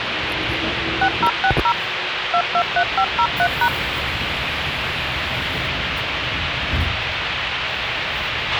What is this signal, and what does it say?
DTMF, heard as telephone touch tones, dialled by machine, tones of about 70 ms, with radio hiss, a squelch burst at the end and the noise inside a subway train. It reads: 6060 223503#